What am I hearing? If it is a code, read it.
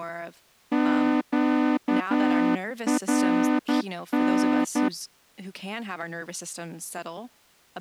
Morse code, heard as a horn, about 11 wpm, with speech in English. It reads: QRN